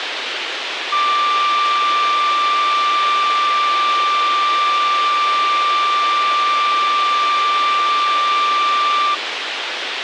A steady tone, with radio hiss and a squelch burst at the end. There is no code.